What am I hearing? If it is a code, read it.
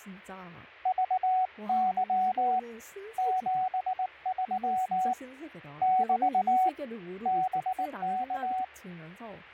Morse code, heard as a keyed tone, hand-sent with a paddle, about 19 wpm, 750 Hz, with speech in Korean. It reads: VY 73 <BT> BK